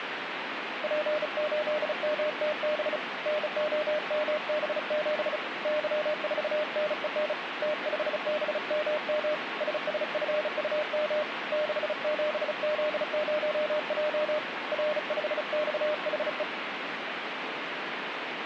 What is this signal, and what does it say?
Morse code, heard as a keyed tone, hand-sent with a bug key, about 35 wpm, 610 Hz, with radio static. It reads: P8MTB NOMB7 Y4NEN T5BMM SSFUM 67Z0J R5XHE